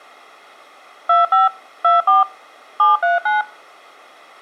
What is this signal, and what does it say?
DTMF, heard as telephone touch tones, dialled by machine, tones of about 160 ms. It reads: 25 24 739